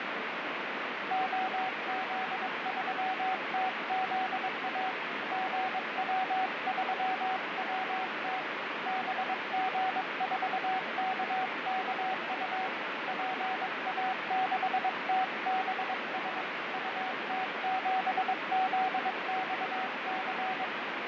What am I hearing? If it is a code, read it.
Morse code, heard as a keyed tone, hand-sent with a paddle, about 22 wpm, 750 Hz, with heavy radio static and fading. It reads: OZ3TZA GW3WT BG4KKU PA6TBS UT7ZXC